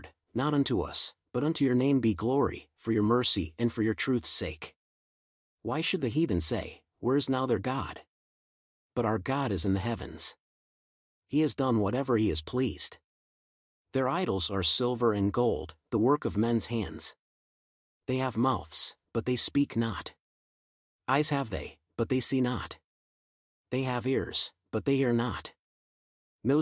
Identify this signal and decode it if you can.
Speech in English. There is no code.